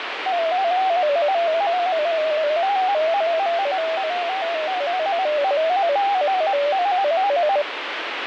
Multi-tone FSK (Olivia or MFSK type), about 250 Hz wide, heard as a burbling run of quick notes, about 15.625 baud, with radio static.